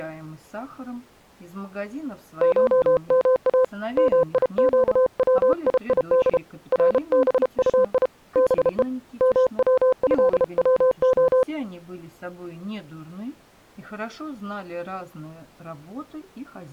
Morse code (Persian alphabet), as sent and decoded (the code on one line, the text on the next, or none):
---- -- .- / -- .. --.- .-- .. .. -.. / .-. -... ..- .. / -... . / -- .-- ..-.. .-- ---
شما میگویید ربطی به موضوع